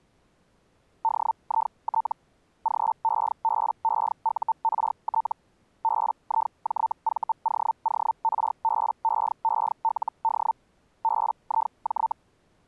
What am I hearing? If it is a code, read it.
Hellschreiber (Feld-Hell, 122.5 baud), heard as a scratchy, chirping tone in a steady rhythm, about 900 Hz. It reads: DIT GEBEURT BIJVOORBEELD BIJ